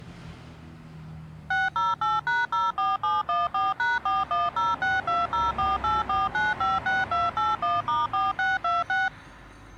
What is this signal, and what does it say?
DTMF, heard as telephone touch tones, dialled by machine, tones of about 180 ms, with street noise. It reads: 608#04714#410620484956281*4626